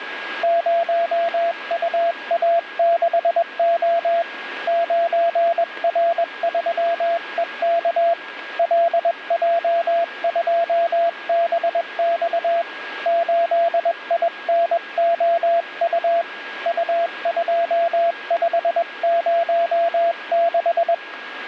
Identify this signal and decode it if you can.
Morse code, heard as a keyed tone, hand-sent with a paddle, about 21 wpm, 680 Hz, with radio static and a steady whistle near 1640 Hz. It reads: 0UA6O 9R3EK LJ2BX 8INOU U2506